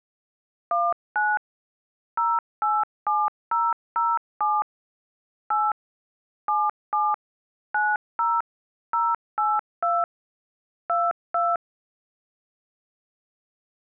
DTMF, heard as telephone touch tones, dialled by machine, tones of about 220 ms. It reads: 19 087007 8 77 90 082 22